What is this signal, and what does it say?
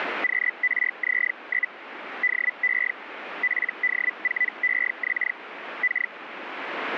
Hellschreiber (Feld-Hell, 122.5 baud), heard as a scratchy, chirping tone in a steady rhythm, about 2000 Hz, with radio static. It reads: QRZ? DE PD4EX K